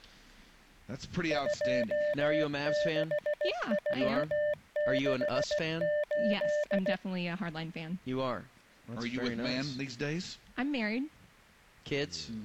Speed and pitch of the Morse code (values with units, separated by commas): 16 wpm, 600 Hz